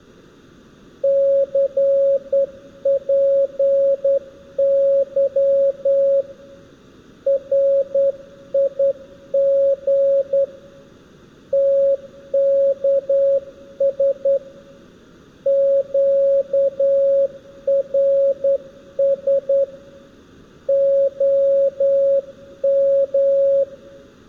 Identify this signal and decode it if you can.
Morse code, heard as a keyed tone, hand-sent with a straight key, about 10 wpm, 550 Hz, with room echo. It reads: CPY RIG TKS QRS OM